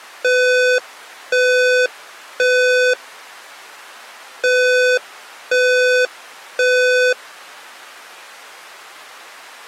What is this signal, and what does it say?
Alarm pattern, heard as an alarm's beeps, played twice, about 500 Hz. Temporal three. Smoke or fire, evacuate.